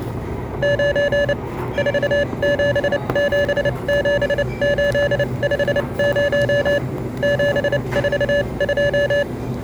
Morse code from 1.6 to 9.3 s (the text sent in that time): 4777850 742